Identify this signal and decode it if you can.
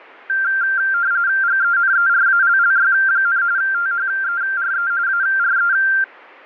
RTTY (45.45 baud, 170 Hz shift), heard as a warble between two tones, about 1480 Hz centre. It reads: GENERALLY, THERE ARE